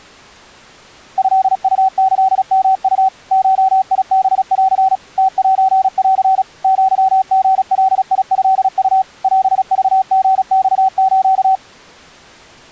Morse code (Japanese Wabun code), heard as a keyed tone, machine-sent, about 36 wpm, 760 Hz. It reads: トウキヨウ ゴハン ムセン アリガトウ オクリマス